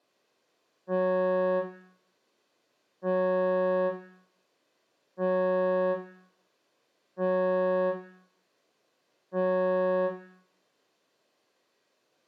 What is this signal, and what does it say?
Ship horn signal, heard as a ship's horn, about 180 Hz, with room echo. 5 short. At sea: I doubt that you are doing enough to avoid a collision.